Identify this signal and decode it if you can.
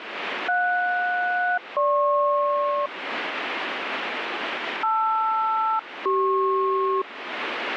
Aircraft SELCAL, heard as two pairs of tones, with radio static. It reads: JS-GP LR-CP